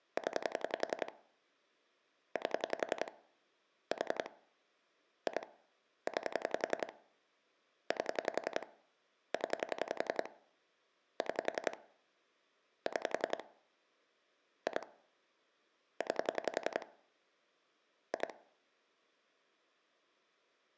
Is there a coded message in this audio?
Yes: pulse dialling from 0.2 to 18.3 s, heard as clicks on a phone line, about 11 pulses a second. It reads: 0 8 4 2 9 8 0 6 6 2 9 2